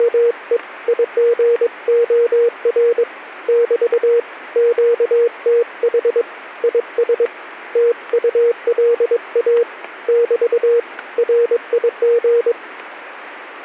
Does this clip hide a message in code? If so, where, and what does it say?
Yes: Morse code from 0.0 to 12.6 s, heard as a keyed tone, hand-sent with a paddle, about 22 wpm, 470 Hz. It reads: … IGOR <BT> QTH IS TULA <BT> RIG